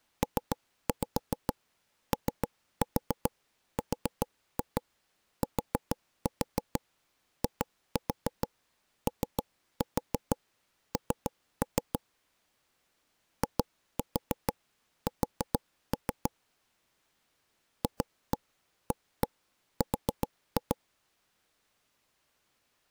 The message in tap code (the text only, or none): PORTION IS FAR